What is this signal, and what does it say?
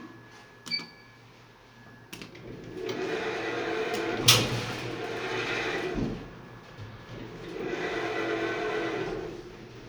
The noise inside a lift. There is no code.